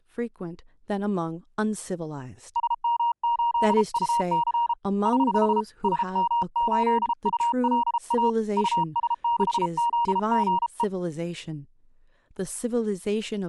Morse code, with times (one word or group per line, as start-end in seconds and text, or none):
2.6-4.7 SM8UC
5.1-5.6 <HH>
5.8-8.3 SM8ULA
8.6-10.8 US6ZGE